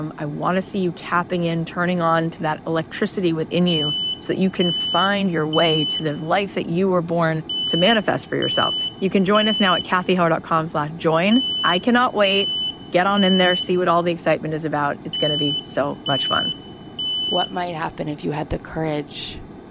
Alarm pattern, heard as an alarm's beeps, played four times, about 3000 Hz, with room echo and speech in English. Temporal three. Smoke or fire, evacuate.